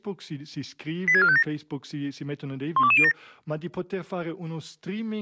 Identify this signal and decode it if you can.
Five-tone selective call (ZVEI), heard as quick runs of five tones, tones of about 70 ms, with speech in Italian. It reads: 86457 12207